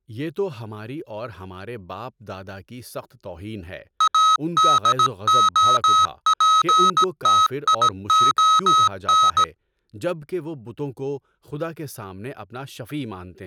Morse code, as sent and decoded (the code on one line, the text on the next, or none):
.- -.. --- .--. - .. --- -.
ADOPTION